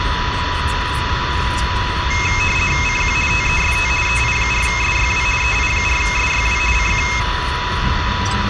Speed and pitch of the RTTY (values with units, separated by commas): 50 baud, 450 Hz shift, 2350 Hz centre